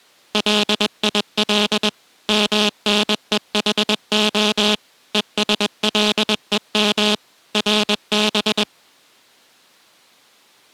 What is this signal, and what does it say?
Morse code (Hebrew alphabet), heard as a buzzer, machine-sent, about 21 wpm. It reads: ליל מנוחה ושלום רב